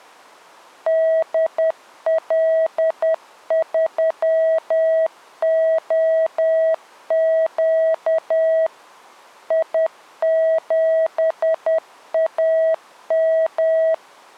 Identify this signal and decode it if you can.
Morse code, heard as a keyed tone, machine-sent, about 10 wpm, 650 Hz. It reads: DL3OQ I7AM